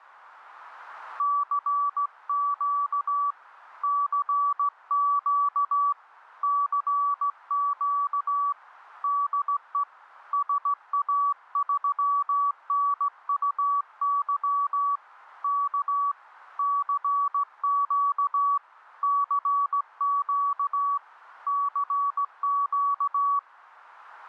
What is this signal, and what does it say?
Morse code, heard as a keyed tone, hand-sent with a straight key, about 16 wpm, 1140 Hz. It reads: CQ CQ CQ DE SA3NUY K CQ CQ CQ